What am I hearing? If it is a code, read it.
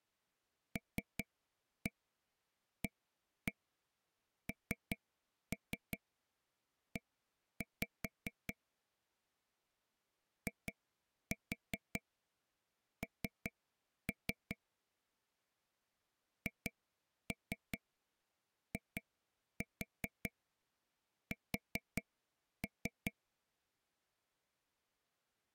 Tap code, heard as taps on a table, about 5 knocks a second. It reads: LANE IN HIS